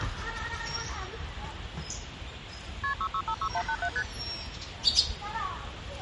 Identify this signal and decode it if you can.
Multi-frequency trunk signalling (R1, as on North American trunks), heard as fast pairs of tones, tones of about 70 ms, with the noise of a park. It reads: KP 6656187 ST